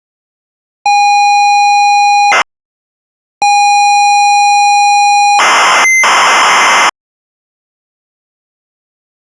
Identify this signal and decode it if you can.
ZX Spectrum tape loading, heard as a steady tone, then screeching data.